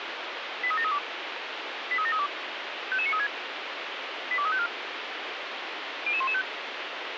Five-tone selective call (ZVEI), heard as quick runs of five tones, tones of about 70 ms, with radio hiss. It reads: 83732 83732 55936 82354 00115